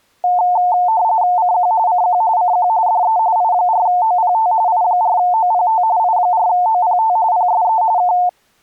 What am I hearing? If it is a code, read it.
RTTY (45.45 baud, 170 Hz shift), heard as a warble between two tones, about 800 Hz centre. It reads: CQ CQ CQ DE I4OPT I4OPT I4OPT PSE K